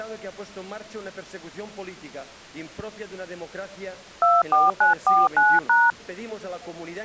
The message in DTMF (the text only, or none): 24949#